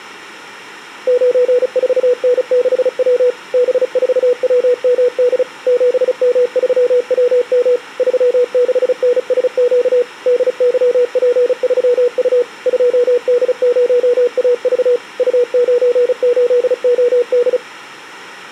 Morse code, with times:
1.1-3.3 94N6W
3.5-5.4 B4WMD
5.7-7.8 7M3WM
8.0-10.0 36NSQ
10.3-12.4 DYP3U
12.7-15.0 2D0AV
15.2-17.6 U98OD

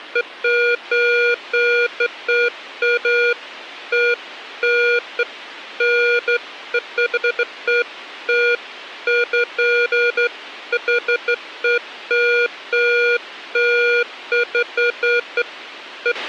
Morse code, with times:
none

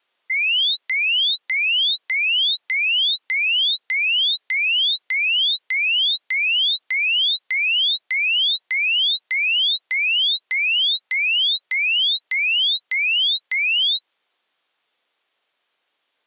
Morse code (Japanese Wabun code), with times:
none

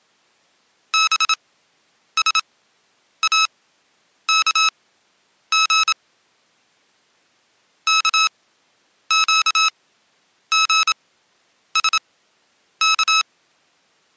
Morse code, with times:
0.9-5.9 BSAKG
7.9-13.2 KQGSK

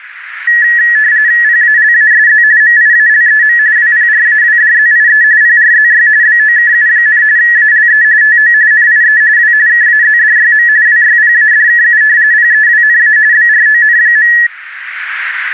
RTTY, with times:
1.4-2.4 PALASZ
2.6-3.6 MIALEM
3.8-5.2 WPRAWDZIE
5.4-6.1 PRZY
6.2-7.2 BOKU,
7.4-8.0 ALE
8.2-8.5 TO
8.7-9.2 NIE
9.4-9.5 W
9.7-10.7 KAZDYM
10.9-12.0 WYPADKU
12.3-13.2 PEWNA
13.3-14.3 BRON.

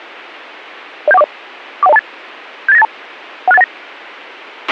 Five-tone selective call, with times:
1.1-1.2 07140
1.8-2.0 41028
2.7-2.8 78982
3.5-3.6 16819

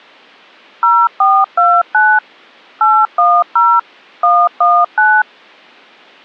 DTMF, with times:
0.8-2.2 0429
2.8-3.8 810
4.2-5.2 119

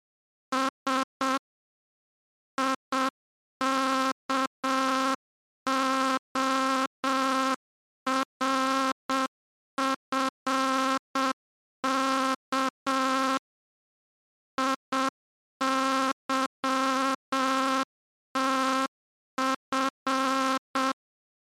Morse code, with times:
0.5-1.4 S
2.6-13.4 IKORFK
14.6-20.9 IYTF

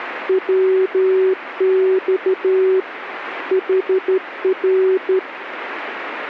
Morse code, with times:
0.3-2.8 WX
3.5-5.2 HR

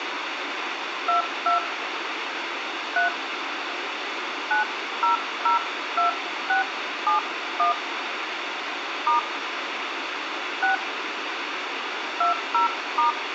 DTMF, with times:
1.1-1.6 22
3.0-3.1 3
4.5-7.7 9002671
9.1-9.2 *
10.6-10.7 6
12.2-13.1 20*

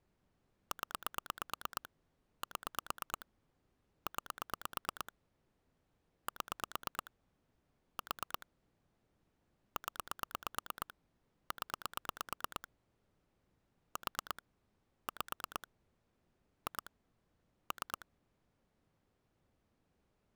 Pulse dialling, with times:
0.7-1.9 0
2.4-3.3 7
4.1-5.1 9
6.3-7.1 7
8.0-8.5 4
9.8-10.9 0
11.5-12.7 0
14.0-14.4 4
15.1-15.7 5
16.7-16.9 2
17.7-18.1 3

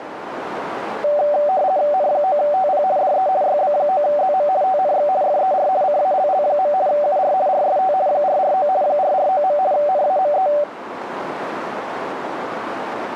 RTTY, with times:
1.9-2.8 N9TP
3.0-3.3 DE
3.4-4.5 YB9ZM
4.6-5.1 TNX
5.2-5.7 FER
5.8-6.7 CALL.
6.9-7.3 UR
7.5-7.9 RST
8.1-8.7 449
8.8-9.6 449.
9.7-10.5 NAME

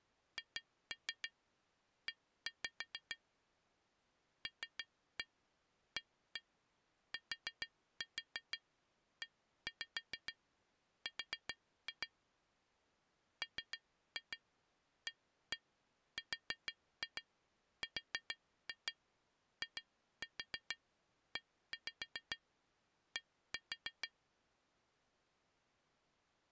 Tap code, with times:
0.4-3.2 HE
4.5-12.1 LATER
13.4-24.1 MARRIED

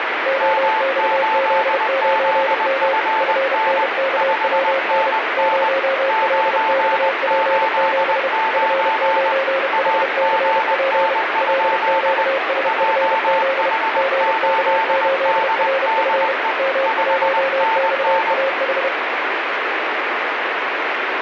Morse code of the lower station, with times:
0.3-2.9 OXZ9M
3.2-5.1 FNKWN
5.4-8.3 0LXP7
8.5-11.1 F9HCP
11.4-13.7 LQSFZ
14.0-16.3 GK8RF
16.6-18.9 M1XAH

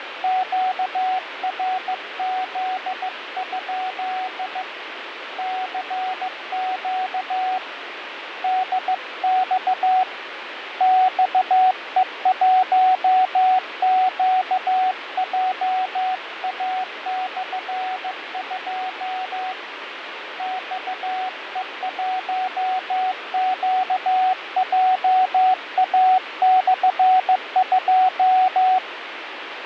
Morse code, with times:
0.2-4.6 QRZ?
5.4-7.6 CQ
8.4-10.0 DX
10.8-19.5 XE1QJA/2
20.4-28.8 XE1QJA/2

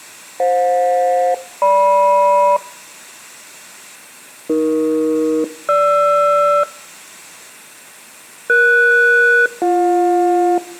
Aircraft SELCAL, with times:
0.4-2.6 FJ-GM
4.5-6.6 AE-GR
8.5-10.6 ES-BJ

